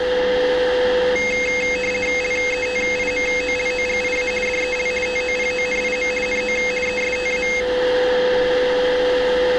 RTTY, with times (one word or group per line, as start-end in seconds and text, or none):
2.2-4.3 LETIMOLOGIA
4.5-4.9 DEL
5.1-6.1 TOPONIM
6.3-6.6 NO
6.9-7.5 ESTA